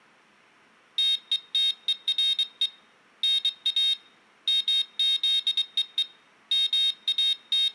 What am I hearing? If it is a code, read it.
Morse code, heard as a high beeper, hand-sent with a bug key, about 23 wpm, 3700 Hz, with room echo. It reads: TETERE NA MZEE …